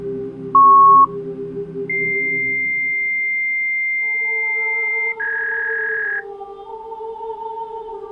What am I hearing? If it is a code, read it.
Fax machine handshake, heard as a beep, a long tone and a warble.